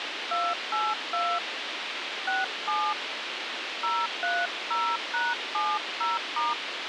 DTMF, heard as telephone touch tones, dialled by hand, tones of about 220 ms, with radio hiss and a squelch burst at the end. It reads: 282 67 030#70*